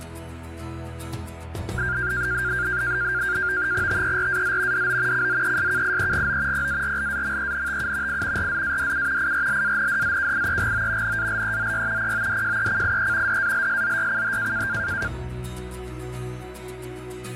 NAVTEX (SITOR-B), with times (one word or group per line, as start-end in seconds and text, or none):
3.9-4.9 TERAZ
4.7-5.3 DO
5.1-6.7 CZESKIEGO
6.5-8.2 PARLAMENTU
8.1-8.5 I
8.4-9.3 RZADU
9.2-11.2 IRLANDZKIEGO
11.0-12.1 NALEZY
12.0-13.4 PODJECIE
13.3-14.7 DALSZYCH